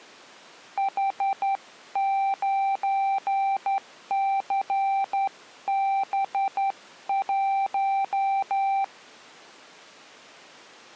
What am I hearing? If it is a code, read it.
Morse code, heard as a keyed tone, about 11 wpm, 780 Hz. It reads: H9CB1